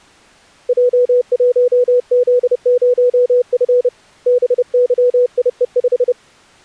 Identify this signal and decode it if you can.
Morse code, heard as a keyed tone, hand-sent with a paddle, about 30 wpm, 490 Hz. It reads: J1Z0F BYIE5